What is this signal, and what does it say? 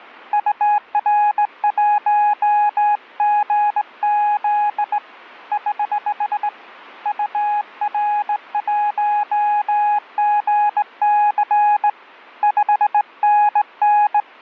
Morse code, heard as a keyed tone, hand-sent with a straight key, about 18 wpm, 830 Hz, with radio static. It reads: UR1GZ <HH> UR1GC 5NN